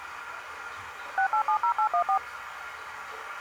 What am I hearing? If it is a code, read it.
DTMF, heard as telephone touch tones, dialled by machine, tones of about 90 ms, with the noise of a restroom. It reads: 6870814